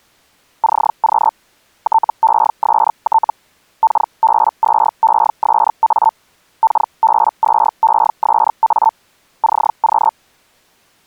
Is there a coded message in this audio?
Yes: Hellschreiber (Feld-Hell, 122.5 baud) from 0.6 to 10.1 s, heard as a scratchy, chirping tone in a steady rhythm, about 890 Hz. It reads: CQ TEST KB2ESA KB2ESA CQ